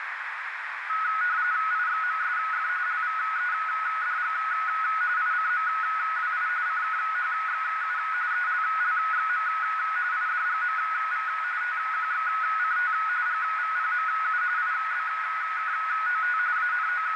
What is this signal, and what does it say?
RTTY (45.45 baud, 170 Hz shift), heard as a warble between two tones, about 1370 Hz centre, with radio static and a narrow filter. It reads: IXMSF LVEDG ICMWI CKHXU ELLXM IDGMV TQXCT GVPMU IBKOT …